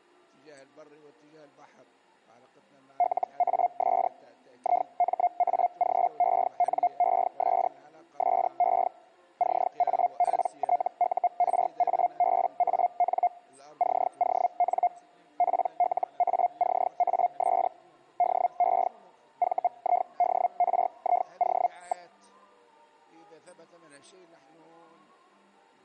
Hellschreiber (Feld-Hell, 122.5 baud), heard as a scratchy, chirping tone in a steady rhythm, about 710 Hz. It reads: LAS IMAGENES SE CAPTURABAN CON PLACAS DE VIDRIO.